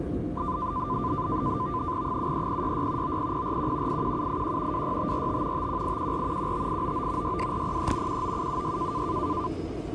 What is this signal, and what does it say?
NAVTEX (SITOR-B), 100 baud, 170 Hz shift, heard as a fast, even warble, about 1100 Hz centre, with the noise inside a subway train. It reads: 73066 90041 81781 26545 51814 15899 62403 19776